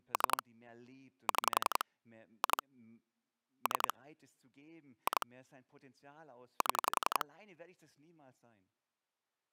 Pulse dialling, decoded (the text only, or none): 3 6 2 3 2 7